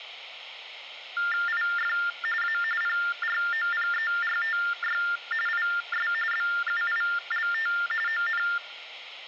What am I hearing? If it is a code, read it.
TTY/TDD text telephone tones (45.45 baud Baudot), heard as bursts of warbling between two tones, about 400 Hz shift, 1600 Hz centre. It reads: IF A PROPERTY IS BUILT ON